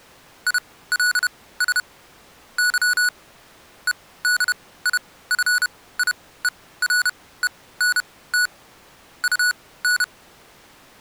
Morse code, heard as electronic beeps, machine-sent, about 31 wpm, spaced as for 18 wpm, 1470 Hz. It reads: ILS Y EDIFIERENT UN